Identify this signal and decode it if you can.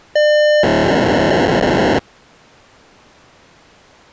POCSAG pager data (1200 baud), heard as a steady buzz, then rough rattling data.